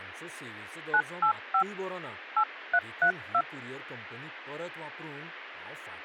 DTMF, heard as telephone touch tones, dialled by hand, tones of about 80 ms, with a squelch burst at the end and speech in Goan Konkani. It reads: 985 8332